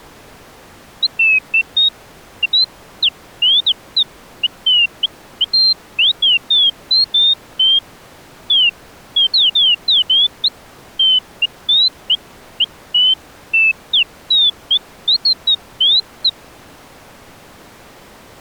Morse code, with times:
none

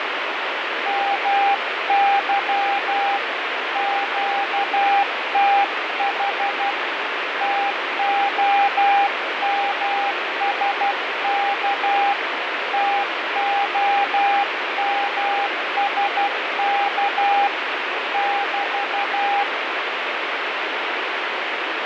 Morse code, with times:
0.9-3.2 MY
3.8-6.7 QTH
7.4-12.1 TOMSK
12.7-17.5 TOMSK
18.1-19.4 <BT>

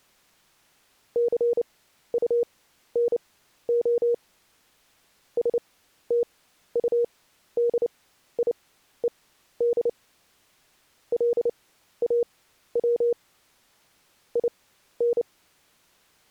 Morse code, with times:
1.2-4.1 CUNO
5.4-9.9 STUDIED
11.1-13.1 LAW
14.4-15.2 IN

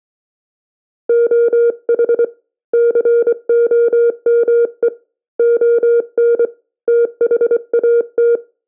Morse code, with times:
1.1-2.2 OH
2.7-4.9 COME
5.4-6.4 ON
6.9-8.4 THAT

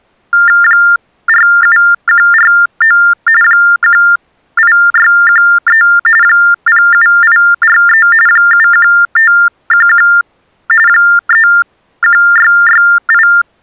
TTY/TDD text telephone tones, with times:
0.6-3.0 47149
3.4-5.8 18613
6.2-8.1 07843
8.3-10.1 71511
10.9-13.3 31668

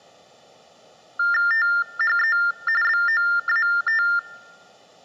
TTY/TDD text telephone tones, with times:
1.5-2.4 THE
2.8-4.0 BOAT

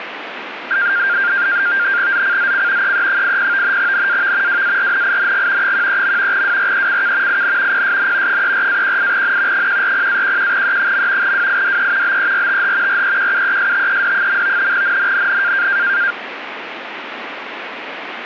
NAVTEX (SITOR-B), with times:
2.1-2.9 ZCZC
2.8-3.8 EE80
3.8-4.6 NAV
4.5-5.7 WARNING
5.6-6.4 13.
6.3-7.4 WRECK
7.3-7.8 IN
7.7-8.4 PSN
8.3-9.7 34-18N
9.5-11.3 140-11E.
11.2-12.2 WIDE
12.0-13.0 BERTH
12.9-14.7 REQUESTED.
14.7-15.7 NNNN

